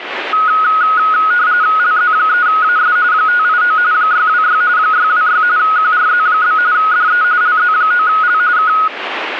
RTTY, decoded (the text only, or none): LZ3AS 589 626 626 QRZ? DE LZ9L K